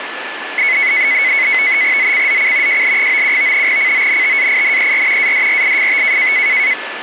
NAVTEX (SITOR-B), 100 baud, 170 Hz shift, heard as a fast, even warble, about 2100 Hz centre, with radio static and a steady whistle near 1740 Hz. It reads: ZCZC JL97 CONTAINER ADRIFT